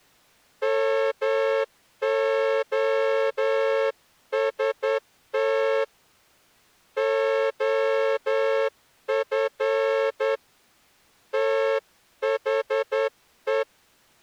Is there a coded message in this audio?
Yes: Morse code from 0.6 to 13.7 s, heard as a horn, hand-sent with a straight key, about 10 wpm. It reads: MOST OF THE